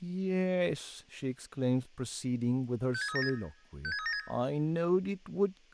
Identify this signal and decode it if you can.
Five-tone selective call (ZVEI), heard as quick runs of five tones, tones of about 70 ms, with room echo and speech in English. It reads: 56376 56376